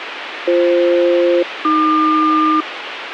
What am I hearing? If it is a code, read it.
Aircraft SELCAL, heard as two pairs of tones, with radio hiss. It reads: BF-AQ